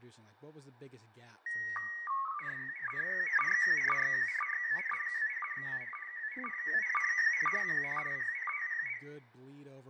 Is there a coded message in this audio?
Yes: SSTV (slow-scan television), PD 120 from 1.5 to 9.0 s, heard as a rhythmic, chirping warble, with fading, room echo and speech in English.